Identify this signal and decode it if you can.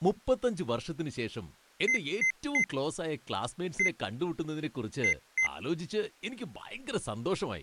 Beep code, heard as beeps, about 2050 Hz, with speech in Malayalam. 3-1-2. In Phoenix BIOS tables: DMA register failure.